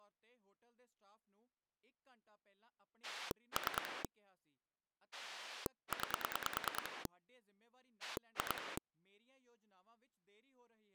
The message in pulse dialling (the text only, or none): 3 9 2